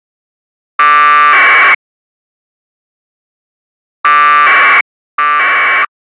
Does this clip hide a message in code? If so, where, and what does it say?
Yes: packet radio (AX.25, as in APRS), 1200 baud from 0.8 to 5.9 s, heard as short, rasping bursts.